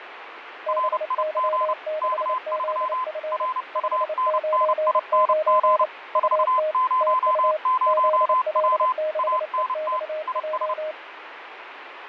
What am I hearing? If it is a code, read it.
Morse code, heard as two keyed tones, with radio static. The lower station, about 28 wpm, 620 Hz: BY6ZF 599 UT TU ZL6EXJ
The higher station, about 30 wpm, 1020 Hz: RIG K3 RUNNING 400W ANT IS